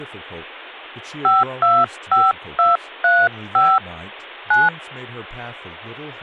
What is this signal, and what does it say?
DTMF, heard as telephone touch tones, dialled by hand, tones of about 210 ms, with speech in English. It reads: 525235 9